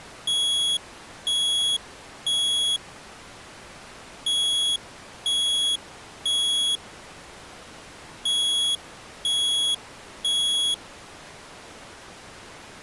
Alarm pattern, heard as an alarm's beeps, played three times, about 3350 Hz. Temporal three. Smoke or fire, evacuate.